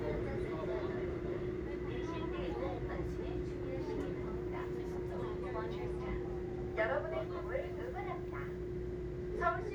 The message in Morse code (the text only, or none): none